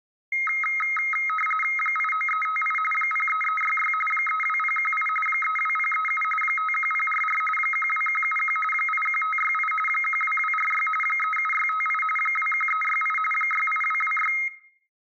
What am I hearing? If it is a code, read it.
RTTY (45.45 baud, 850 Hz shift), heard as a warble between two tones, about 1700 Hz centre, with room echo. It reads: 89358 03366 32018 32037 51044 12171 81568 12246 37658 21368 68226